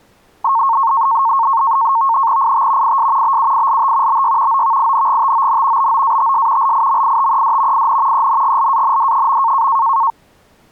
NAVTEX (SITOR-B), 100 baud, 170 Hz shift, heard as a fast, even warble, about 1000 Hz centre. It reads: IT IS BUILT BY OVINGTON BOATS LIMITED IN ENGLAND.